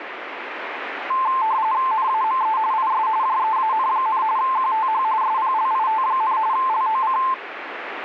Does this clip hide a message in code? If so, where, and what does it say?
Yes: RTTY (45.45 baud, 170 Hz shift) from 1.1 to 7.3 s, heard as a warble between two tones, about 960 Hz centre, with radio static. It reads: NAME IS JEAN, QTH SPLIT, LOC